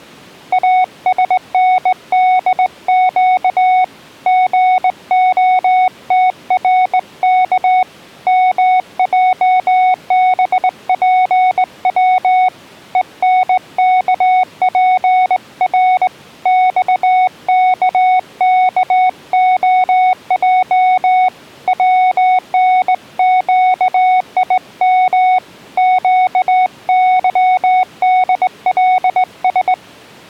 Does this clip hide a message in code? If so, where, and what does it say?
Yes: Morse code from 0.5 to 29.8 s, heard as a keyed tone, hand-sent with a straight key, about 19 wpm, 740 Hz. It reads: ASNDQ GOTRK MJBPW ENKPR XKKOJ WNQIM QYDLS